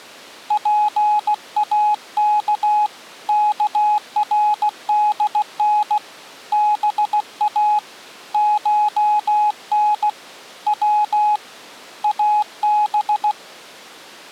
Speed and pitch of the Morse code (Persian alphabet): 16 wpm, 840 Hz

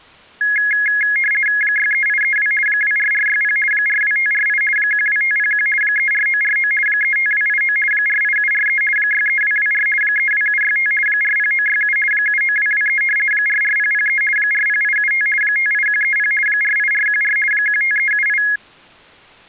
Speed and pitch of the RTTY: 50 baud, 450 Hz shift, 1900 Hz centre

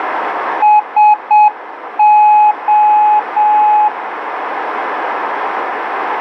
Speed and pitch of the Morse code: 7 wpm, 840 Hz

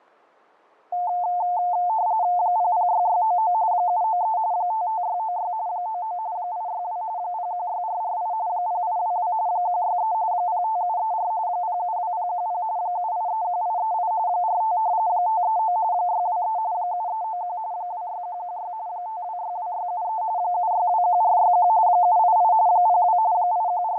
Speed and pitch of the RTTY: 45.45 baud, 170 Hz shift, 800 Hz centre

